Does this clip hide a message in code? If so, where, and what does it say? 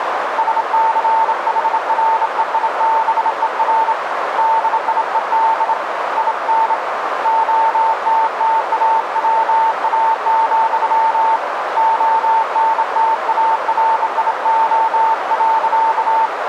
Yes: Morse code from 0.3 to 16.3 s, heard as a keyed tone, hand-sent with a bug key, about 27 wpm, 900 Hz, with radio static and a narrow filter. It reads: SCHREIBER DIED IN OTTAWA, ONTARIO.